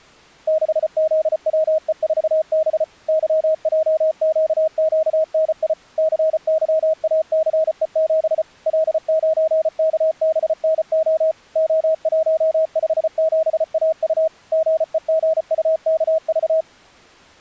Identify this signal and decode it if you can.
Morse code, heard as a keyed tone, machine-sent, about 34 wpm, 630 Hz. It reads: 6ZWE4B YJQQNI CYACE7 L9KBNO O157AU GEGUKV